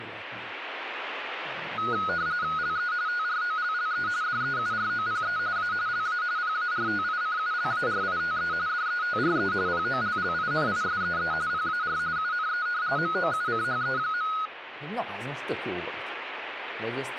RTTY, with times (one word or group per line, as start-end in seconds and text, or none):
2.6-2.9 LE
3.1-4.1 TROLLE
4.2-5.4 DEUROPE
5.6-5.7 A
5.9-6.2 LA
6.4-8.5 PARTICULARITE
8.7-9.5 DETRE
9.7-11.3 POLLINISEE
11.5-12.0 PAR
12.2-12.7 UNE
13.0-14.3 MOUCHE.